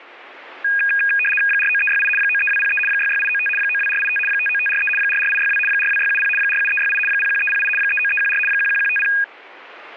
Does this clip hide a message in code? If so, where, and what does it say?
Yes: RTTY (75 baud, 850 Hz shift) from 0.6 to 9.2 s, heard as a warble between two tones, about 2050 Hz centre. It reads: 49368 93203 66895 92485 59543 44862 42670 47368 01308 39314 11150